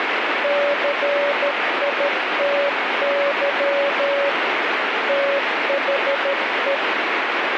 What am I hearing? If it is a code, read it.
Morse code, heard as a keyed tone, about 13 wpm, 560 Hz, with radio static. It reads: CITY THE